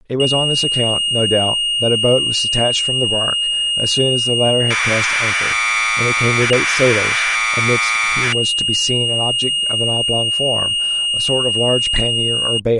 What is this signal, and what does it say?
Commodore tape loading (standard loader), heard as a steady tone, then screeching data, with speech in English.